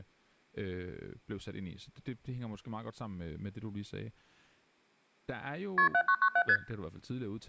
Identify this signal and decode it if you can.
Multi-frequency trunk signalling (R1, as on North American trunks), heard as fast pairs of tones, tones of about 70 ms, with speech in Danish. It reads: KP 7997 ST